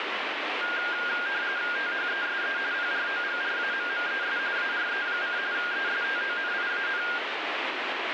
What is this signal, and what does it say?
RTTY (45.45 baud, 170 Hz shift), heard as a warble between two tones, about 1500 Hz centre, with radio static. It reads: THESE PROGRAMMES ARE: ESTONIAN